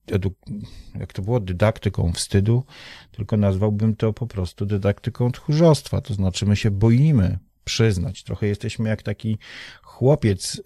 Speech in Polish. There is no code.